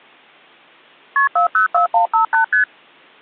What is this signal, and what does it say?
Multi-frequency trunk signalling (R1, as on North American trunks), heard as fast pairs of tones, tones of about 120 ms. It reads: KP 404158 ST